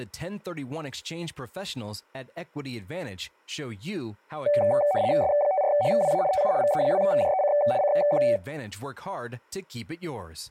RTTY (75 baud, 170 Hz shift), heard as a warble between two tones, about 670 Hz centre, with speech in English. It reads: S54HWA TU VE2JEC CQ